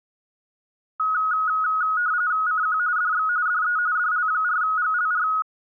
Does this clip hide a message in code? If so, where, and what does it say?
Yes: RTTY (45.45 baud, 170 Hz shift) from 1.0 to 5.4 s, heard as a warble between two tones, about 1360 Hz centre. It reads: CQ DX DE DL4GLR